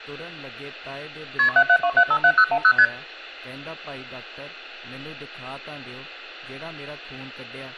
Multi-frequency trunk signalling (R1, as on North American trunks), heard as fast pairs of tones, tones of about 70 ms, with hum and speech in Punjabi. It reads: KP 772757010 ST